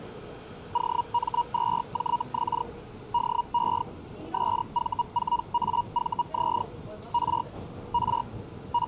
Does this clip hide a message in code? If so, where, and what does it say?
Yes: Hellschreiber (Feld-Hell, 122.5 baud) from 0.7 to 8.9 s, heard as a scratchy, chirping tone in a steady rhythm, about 950 Hz, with the noise inside a subway train. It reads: OM2JX DE SV4AVZ R R …